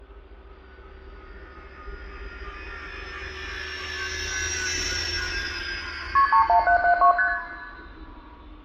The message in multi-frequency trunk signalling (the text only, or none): KP 31772 ST